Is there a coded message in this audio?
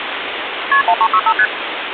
Yes: multi-frequency trunk signalling (R1, as on North American trunks) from 0.7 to 1.5 s, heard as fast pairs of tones, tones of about 60 ms, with phone line noise. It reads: KP 1365 ST